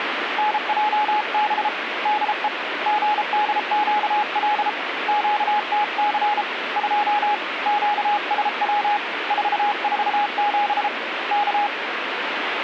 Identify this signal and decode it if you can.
Morse code, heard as a keyed tone, hand-sent with a paddle, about 33 wpm, 840 Hz, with radio static. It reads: NJB DE GDQL QTC 2 QSW 447 K